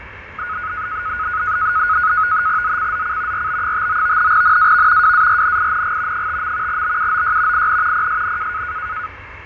NAVTEX (SITOR-B), 100 baud, 170 Hz shift, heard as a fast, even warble, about 1360 Hz centre, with radio static, fading, a steady whistle near 1940 Hz and the noise of a residential street. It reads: ZCZC RB59 NAV WARNING 5. BUOY IN PSN